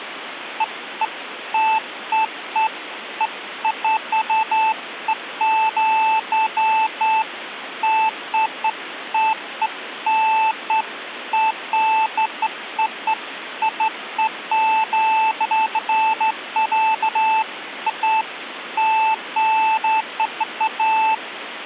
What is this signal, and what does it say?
Beeps of irregular length, with phone line noise. There is no code.